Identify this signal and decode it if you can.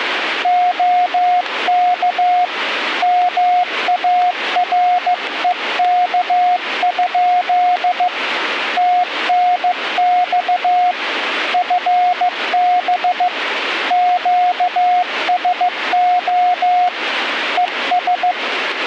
Morse code, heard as a keyed tone, hand-sent with a paddle, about 15 wpm, 720 Hz, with radio static. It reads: OK MAREK? TNX FB QSO ES